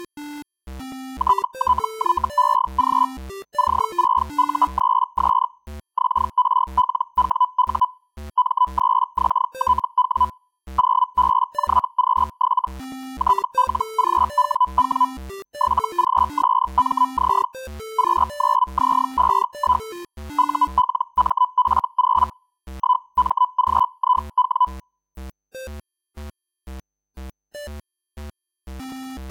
Hellschreiber (Feld-Hell, 122.5 baud), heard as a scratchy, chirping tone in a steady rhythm, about 1000 Hz. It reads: TTYEG C6U3S XRLWU M3XTW 0BJQ7 TLGWW 7GSMZ Q9Z51 ULMF0 1MGIW